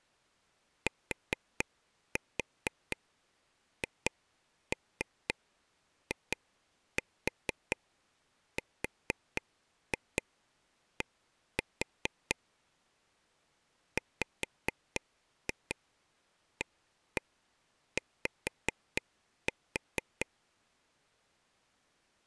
Tap code, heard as taps on a table, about 4 knocks a second. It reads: THIRD WAY